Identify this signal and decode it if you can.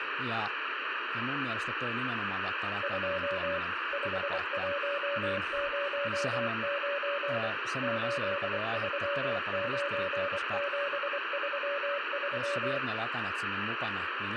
Morse code, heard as a keyed tone, machine-sent, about 24 wpm, 570 Hz, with radio static, room echo and speech in Finnish. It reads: 2 5109 839733